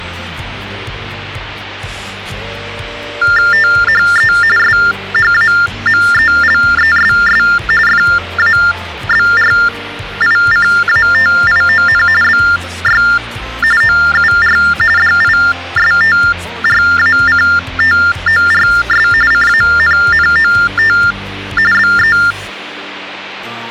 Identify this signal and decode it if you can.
TTY/TDD text telephone tones (45.45 baud Baudot), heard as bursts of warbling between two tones, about 400 Hz shift, 1600 Hz centre. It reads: THE SHAMELESS FABRICATION BY OUR DISTRACTORS CANNOT BE